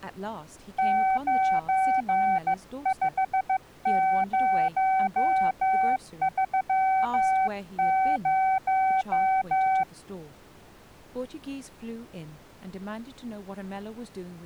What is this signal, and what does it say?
Morse code, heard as a keyed tone, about 15 wpm, 760 Hz, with speech in English. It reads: 95030